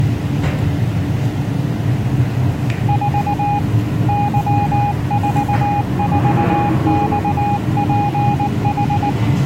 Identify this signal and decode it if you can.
Morse code, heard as a keyed tone, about 19 wpm, 820 Hz, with the noise inside a lift. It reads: 4 Y44XPH